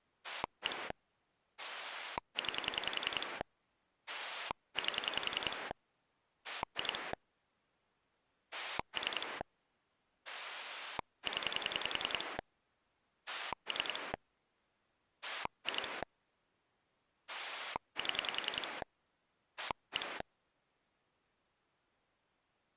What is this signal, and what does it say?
Pulse dialling, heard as a rotary dial, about 10 pulses a second. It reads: 1 9 8 2 3 0 3 2 7 1